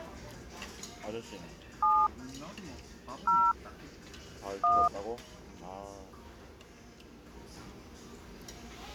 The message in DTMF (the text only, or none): 7 0 1